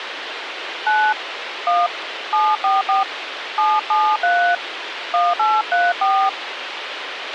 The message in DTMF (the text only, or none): 9 1 744 773 1834